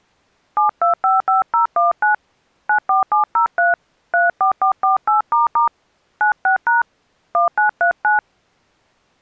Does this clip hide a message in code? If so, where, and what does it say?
Yes: DTMF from 0.6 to 8.2 s, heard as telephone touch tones, dialled by hand, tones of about 130 ms. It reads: 7255019 94703 34448** 96# 1939